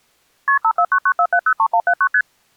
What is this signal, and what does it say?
Multi-frequency trunk signalling (R1, as on North American trunks), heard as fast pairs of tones, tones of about 70 ms. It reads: KP 54994703179 ST